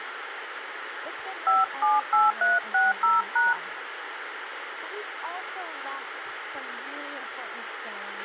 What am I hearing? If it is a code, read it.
DTMF, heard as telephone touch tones, dialled by hand, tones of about 180 ms, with radio hiss, a squelch burst at the end and speech in English. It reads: 578360#